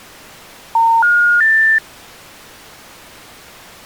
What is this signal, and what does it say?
Telephone call progress tone (North American plan), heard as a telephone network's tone, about 910, 1430, 1800 Hz. Special information tone.